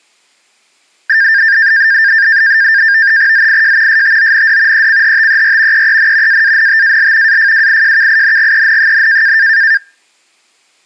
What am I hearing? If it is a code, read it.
NAVTEX (SITOR-B), 100 baud, 170 Hz shift, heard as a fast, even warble, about 1700 Hz centre. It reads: ZIJ STOND ECHTER EEN AANTAL AFWIJKINGEN,